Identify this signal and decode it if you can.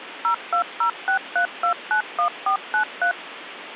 DTMF, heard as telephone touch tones, dialled by machine, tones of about 100 ms, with phone line noise. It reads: 02063291493